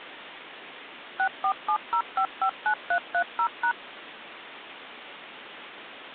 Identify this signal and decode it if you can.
DTMF, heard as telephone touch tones, dialled by machine, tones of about 80 ms, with phone line noise. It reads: 6470559330#